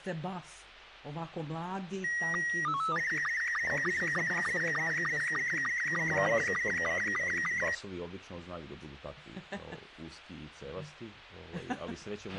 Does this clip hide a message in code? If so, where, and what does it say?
Yes: SSTV (slow-scan television), Robot 72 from 2.0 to 7.7 s, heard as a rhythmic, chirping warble, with a squelch burst at the end.